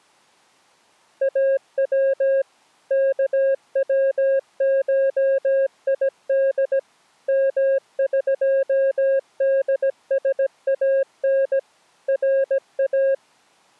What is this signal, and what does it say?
Morse code (Persian alphabet), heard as a keyed tone, machine-sent, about 17 wpm, 540 Hz. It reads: او کوشید مقدسان را